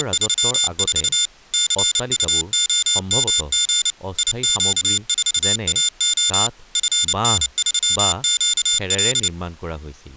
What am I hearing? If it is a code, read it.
Morse code, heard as a high beeper, machine-sent, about 29 wpm, 3550 Hz, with speech in Assamese. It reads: … CUOMG IQ4AO FN3QL